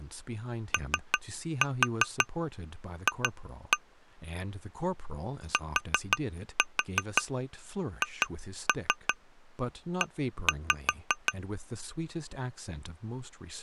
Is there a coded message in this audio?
Yes: tap code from 0.7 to 11.4 s, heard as taps on glass, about 5 knocks a second, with speech in English. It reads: OF THE